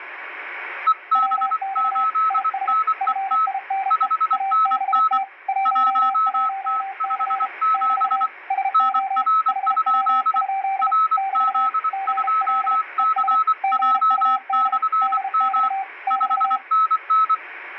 Morse code, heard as two keyed tones, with radio static. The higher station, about 24 wpm, 1300 Hz: EB8NET 5NN 1T57 NR? RZ2CJ/M 5NN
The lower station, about 33 wpm, 780 Hz: WX IS FINE ABT 11C <BT> SO HW? <BT> GL ES GUD DX <BT>